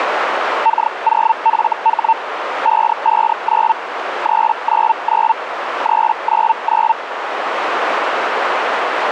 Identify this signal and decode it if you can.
Hellschreiber (Feld-Hell, 122.5 baud), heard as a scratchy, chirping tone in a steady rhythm, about 900 Hz, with radio static and a narrow filter. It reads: K0FH 559 399 399